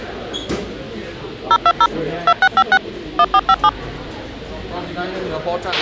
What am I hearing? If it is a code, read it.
DTMF, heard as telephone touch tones, dialled by machine, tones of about 60 ms, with a squelch burst at the end and the noise of a restaurant. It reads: 020 2656 1457